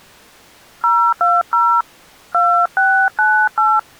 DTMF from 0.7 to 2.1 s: 020

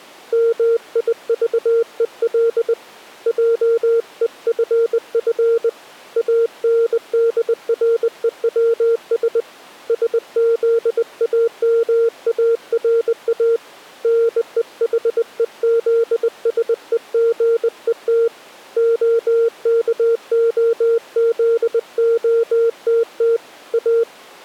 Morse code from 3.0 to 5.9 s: JEFF

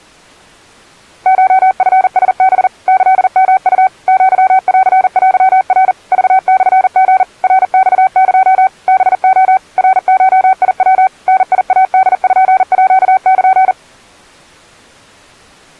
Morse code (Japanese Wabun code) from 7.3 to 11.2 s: ナマエ ハレ ナゴヤ

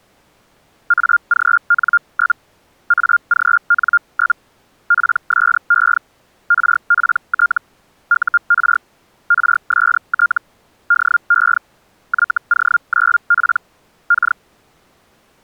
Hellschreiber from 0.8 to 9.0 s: AGN? AGN? PSE RPT UR

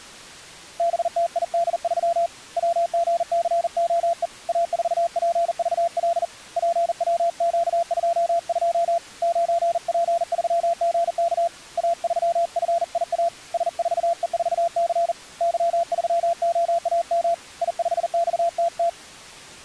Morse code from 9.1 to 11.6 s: 9P3GK

